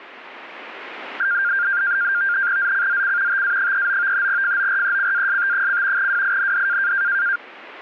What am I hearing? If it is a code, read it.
NAVTEX (SITOR-B), 100 baud, 170 Hz shift, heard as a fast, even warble, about 1500 Hz centre. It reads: ZCZC TA39 FORECAST: WIND